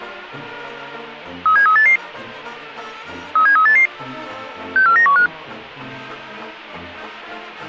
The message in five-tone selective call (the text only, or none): 37388 37388 64915